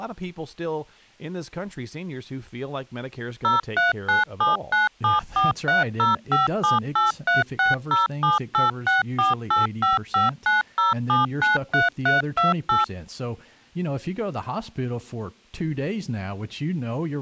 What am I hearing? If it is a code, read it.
DTMF, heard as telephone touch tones, dialled by machine, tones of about 150 ms, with speech in English. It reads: 039797430578360786485590793328